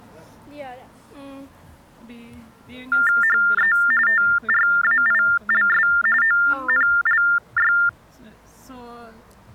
TTY/TDD text telephone tones (45.45 baud Baudot), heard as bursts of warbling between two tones, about 400 Hz shift, 1600 Hz centre. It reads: HE TRAILS ONLY